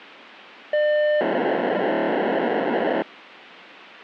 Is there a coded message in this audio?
Yes: POCSAG pager data (1200 baud) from 0.7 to 3.0 s, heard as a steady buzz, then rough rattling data, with radio hiss.